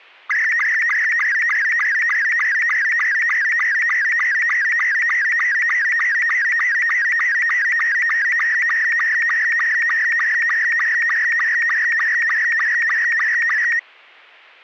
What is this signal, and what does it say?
SSTV (slow-scan television), Robot 72, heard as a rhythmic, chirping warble.